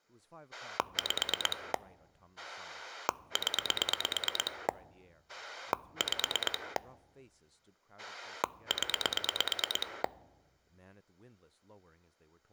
Pulse dialling, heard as a rotary dial, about 9 pulses a second, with speech in English. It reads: 5 0 5 0